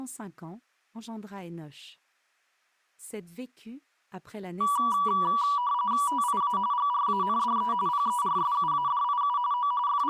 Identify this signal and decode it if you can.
RTTY (45.45 baud, 170 Hz shift), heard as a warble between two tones, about 1060 Hz centre. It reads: TIA GRANDE PERSUADIU O …